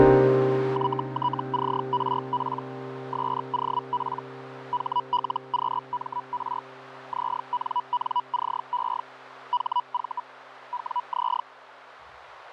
Hellschreiber (Feld-Hell, 122.5 baud), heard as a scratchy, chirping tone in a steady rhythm, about 980 Hz, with radio static and a narrow filter. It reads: YTCRP SOP HLQMR ZNNCE HV WZ